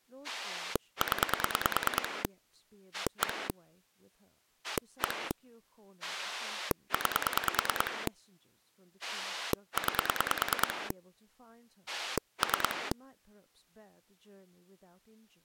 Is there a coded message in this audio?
Yes: pulse dialling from 0.2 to 12.9 s, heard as a rotary dial, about 9 pulses a second, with speech in English. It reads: 0 1 1 9 9 3